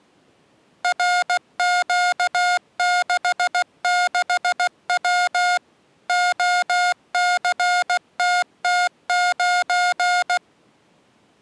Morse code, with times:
0.8-5.6 RQ66W
6.1-10.4 OCTT9

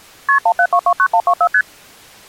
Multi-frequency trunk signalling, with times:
0.3-0.4 KP
0.5-1.5 17229124
1.5-1.6 ST

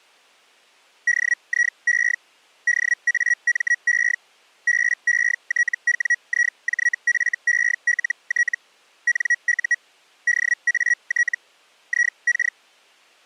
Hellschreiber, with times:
1.1-2.2 DIE
2.7-4.2 DAME
4.7-8.6 BETWIJFELT
9.1-9.8 NU
10.3-11.4 DAT
11.9-12.6 IK

